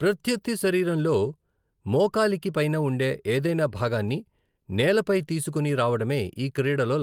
Speech in Telugu. There is no code.